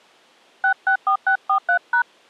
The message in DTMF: 664643#

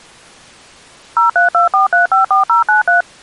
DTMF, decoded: 0324354093

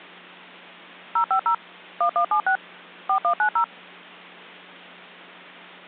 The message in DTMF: 050 1176 4190

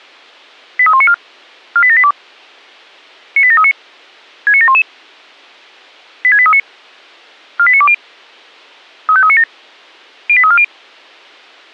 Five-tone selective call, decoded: 83194 48782 98739 69711 86839 48920 35397 08340

